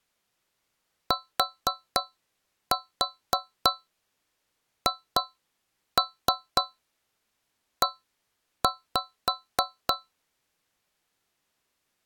Tap code, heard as taps on a metal pipe, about 3 knocks a second. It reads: THE